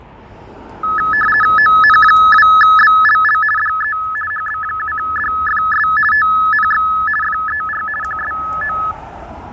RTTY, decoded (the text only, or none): ON2BLL DE HB7DFS TNX FER QSO